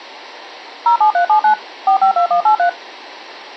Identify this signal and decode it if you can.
DTMF, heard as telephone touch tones, dialled by machine, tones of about 100 ms. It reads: 07379 452183